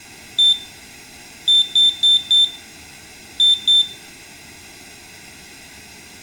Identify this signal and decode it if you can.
Beep code, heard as a piezo beeper, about 3550 Hz, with room echo. 1-4-2. In Phoenix BIOS tables: parity failure in the first 64 KB of memory.